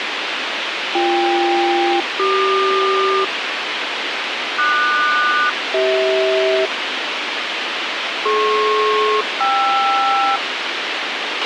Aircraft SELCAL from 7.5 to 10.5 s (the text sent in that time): DP-KR